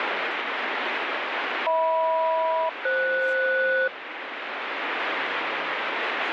Aircraft SELCAL, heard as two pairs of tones, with radio static and speech in English. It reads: HM-FS